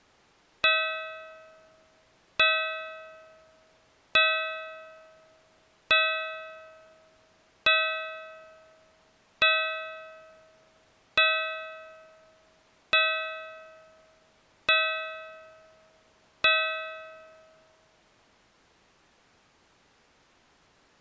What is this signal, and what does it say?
Clock strike, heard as a bell. 10. Ten o'clock.